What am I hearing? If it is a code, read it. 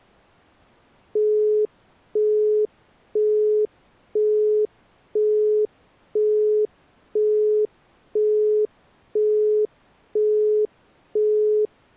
Telephone call progress tone (single-tone plan, as in Europe, Japan and elsewhere), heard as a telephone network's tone, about 420 Hz, 0.5 s on and 0.5 s off. Busy tone.